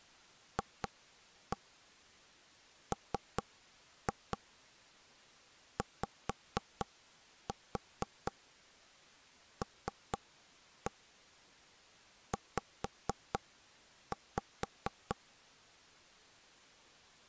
Tap code, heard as taps on a table, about 4 knocks a second. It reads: FMYLZ